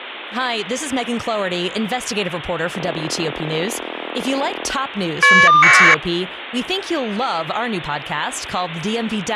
Caller ID data burst, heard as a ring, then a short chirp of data, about 1200 baud, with speech in English.